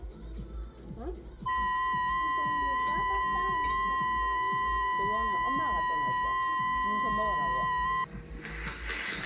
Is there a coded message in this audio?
Yes: FT8 (several signals at once) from 1.5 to 8.0 s, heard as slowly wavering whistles, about 6.25 baud, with the noise of a restaurant.